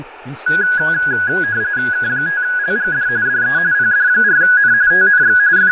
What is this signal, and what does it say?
RTTY (45.45 baud, 170 Hz shift), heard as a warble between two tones, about 1550 Hz centre, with fading, room echo and speech in English. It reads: K5LGD DE PD4N TNX …